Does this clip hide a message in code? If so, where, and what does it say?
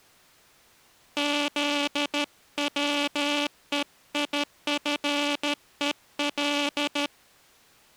Yes: Morse code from 1.1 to 7.1 s, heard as a buzzer, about 13 wpm. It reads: ZWEIFEL